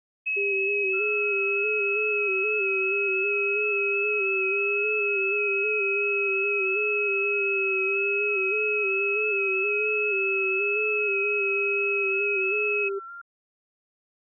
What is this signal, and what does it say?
FT8 (several signals at once), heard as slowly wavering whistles, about 6.25 baud.